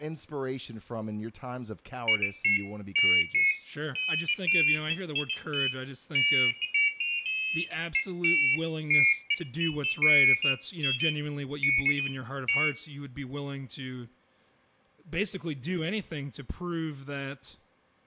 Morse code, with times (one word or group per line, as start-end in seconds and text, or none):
none